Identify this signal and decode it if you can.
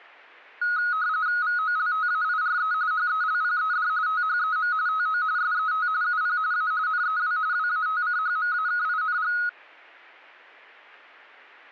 RTTY (45.45 baud, 170 Hz shift), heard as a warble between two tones, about 1360 Hz centre. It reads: VOLTAIRE HELPED THEM TO SET UP A NEW WATCHMAKING